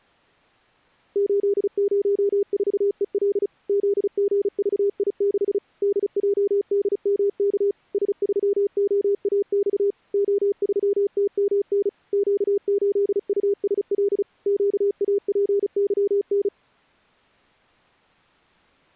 Morse code, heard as a keyed tone, machine-sent, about 35 wpm, 400 Hz. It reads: 804EL ZGVI6 DJDMK S3OAX O3TMN Q8USL QAPYN